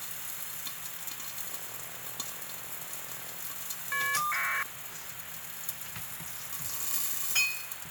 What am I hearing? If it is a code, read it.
Caller ID data burst, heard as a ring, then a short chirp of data, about 1200 baud, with phone line noise and kitchen noise.